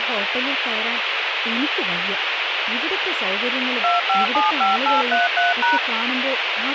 DTMF, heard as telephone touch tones, dialled by machine, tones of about 160 ms, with radio hiss and speech in Malayalam. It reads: 2575833#